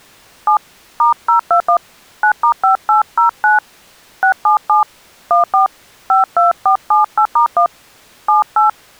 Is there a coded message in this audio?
Yes: DTMF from 0.5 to 8.7 s, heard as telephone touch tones, dialled by hand, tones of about 110 ms. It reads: 7 *021 9*5809 677 14 52478*1 78